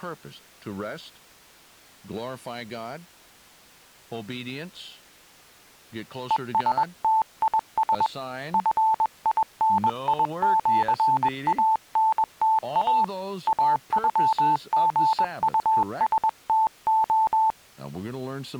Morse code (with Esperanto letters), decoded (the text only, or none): ESTIS FINIĜANTA AŬGUSTO